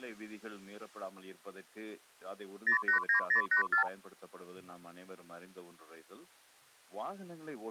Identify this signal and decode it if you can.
Multi-frequency trunk signalling (R2, with the far end's replies), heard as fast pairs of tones, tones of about 110 ms. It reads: 089084